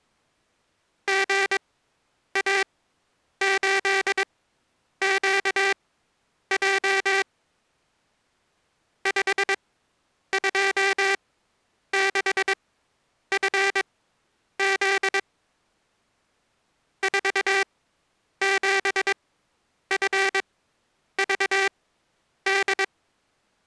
Morse code, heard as a buzzer, machine-sent, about 22 wpm, spaced as for 9 wpm. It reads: GA8QJ 526FZ 47FVD